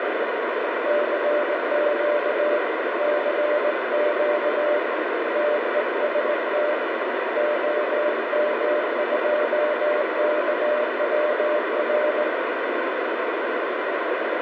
Morse code, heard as a keyed tone, hand-sent with a straight key, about 19 wpm, 600 Hz, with heavy radio static. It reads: CQ CQ TEST OM2KWR